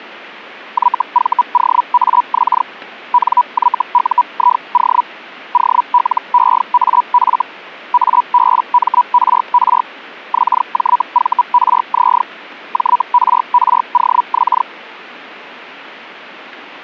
Hellschreiber (Feld-Hell, 122.5 baud), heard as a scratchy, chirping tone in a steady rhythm, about 980 Hz. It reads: YVOAX NYUIO OLEAF ABMRR XJVRZ JRROX